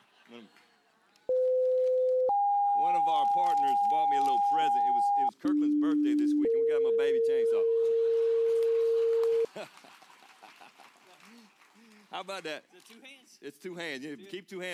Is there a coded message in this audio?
Yes: two-tone page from 1.3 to 9.4 s, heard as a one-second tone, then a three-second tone, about 510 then 810 Hz, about 300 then 460 Hz.